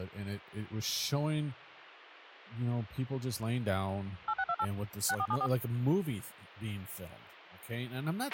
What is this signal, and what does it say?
DTMF, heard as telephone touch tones, dialled by machine, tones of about 60 ms, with a squelch burst at the end and speech in English. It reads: 8628 6474